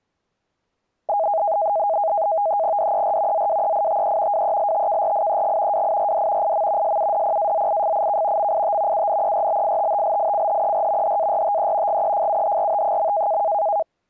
NAVTEX (SITOR-B), 100 baud, 170 Hz shift, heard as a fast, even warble, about 730 Hz centre. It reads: DER ZWEITE WELTKRIEG WIRD IM SUDPAZIFIK MIT UNERBITTLICHER HARTE GEFUHRT.